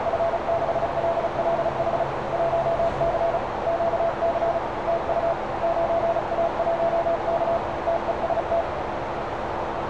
Morse code, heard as a keyed tone, hand-sent with a paddle, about 35 wpm, 670 Hz, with heavy radio static, a narrow filter and street noise. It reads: F6LLH 1C QC TU 9A1K TEST